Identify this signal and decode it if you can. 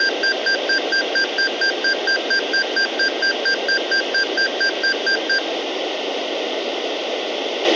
Evenly repeated beeps, with a squelch burst at the end and room echo. There is no code.